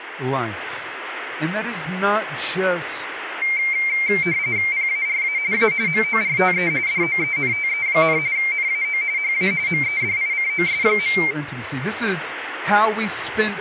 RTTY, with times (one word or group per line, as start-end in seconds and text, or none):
4.7-5.4 PARA
5.5-5.7 A
5.9-6.7 MORTE
6.9-8.2 DOENTE,
8.4-9.0 NAO
9.2-9.5 HA
9.7-11.2 MEDICOS.